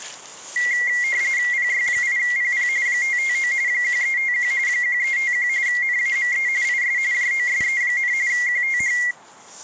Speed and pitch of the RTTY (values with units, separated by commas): 45.45 baud, 170 Hz shift, 2050 Hz centre